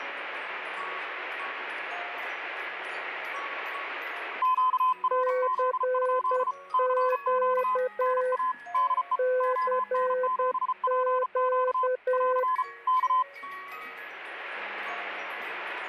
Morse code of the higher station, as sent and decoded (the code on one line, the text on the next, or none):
--.- .-. --.. ..--.. / -.-. --.- / -. .- / -.. . / --- -. --... .--. --.- / .-.-. / -.-
QRZ? CQ NA DE ON7PQ <AR> K